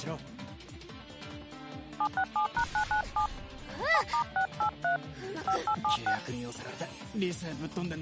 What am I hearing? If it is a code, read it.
DTMF, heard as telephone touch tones, dialled by hand, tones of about 90 ms. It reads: 767#997 7*683 5876